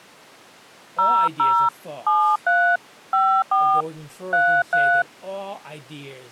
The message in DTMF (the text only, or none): 00 73 54 33